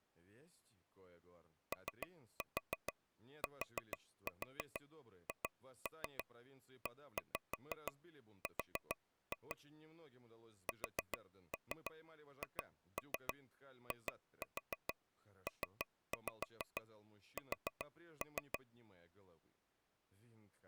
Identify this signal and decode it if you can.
Tap code, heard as taps on a table, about 6 knocks a second, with speech in Russian. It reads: OTHER SHIPS